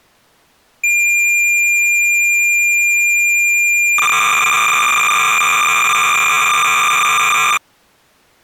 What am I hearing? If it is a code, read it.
Cassette data (Kansas City type), 300 baud, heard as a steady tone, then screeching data.